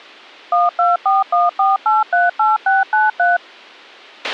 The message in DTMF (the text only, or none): 12414838693